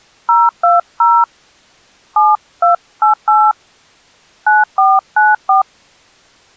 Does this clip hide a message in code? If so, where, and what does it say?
Yes: DTMF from 0.3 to 5.6 s, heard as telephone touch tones, dialled by hand, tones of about 170 ms. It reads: 020 7288 9494